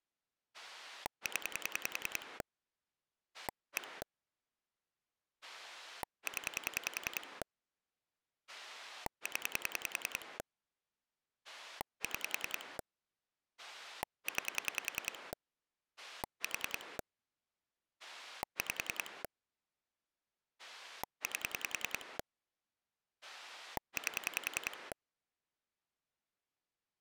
Pulse dialling, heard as a rotary dial, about 10 pulses a second. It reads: 0 1 0 0 6 9 4 5 8 8